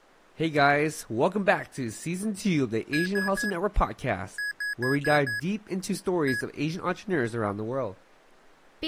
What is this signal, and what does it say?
Beep code, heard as beeps from a small speaker, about 1650 Hz, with speech in English. 3-5-1.